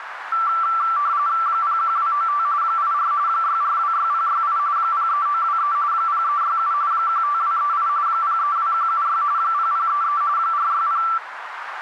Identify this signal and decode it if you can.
RTTY (45.45 baud, 170 Hz shift), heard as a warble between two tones, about 1250 Hz centre, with radio static and a narrow filter. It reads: 01295 84 6426068 03923 0367 15238 032176 0033 460